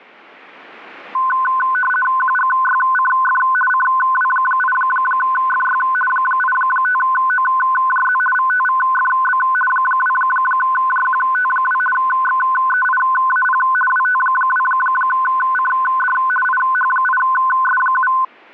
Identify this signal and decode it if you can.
RTTY (50 baud, 450 Hz shift), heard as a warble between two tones, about 1270 Hz centre. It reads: QGYCF CW8FY 85OJZ VTVFB 2JQT2 XEIAP WT2CD IH8S7